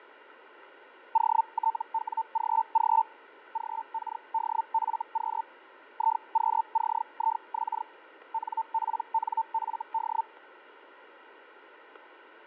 Hellschreiber (Feld-Hell, 122.5 baud), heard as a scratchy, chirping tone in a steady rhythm, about 900 Hz, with radio static and fading. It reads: OTWGG GKDFQ IQCIX NPNFD